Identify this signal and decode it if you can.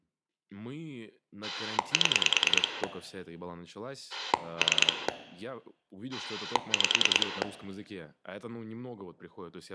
Pulse dialling, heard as a rotary dial, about 10 pulses a second, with room echo and speech in Russian. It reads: 7 3 5